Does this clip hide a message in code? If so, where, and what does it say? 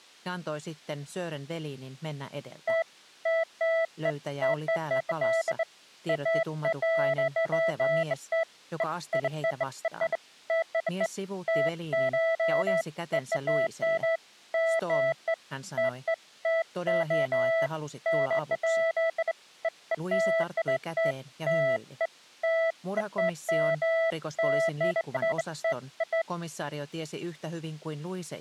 No, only beeps of irregular length.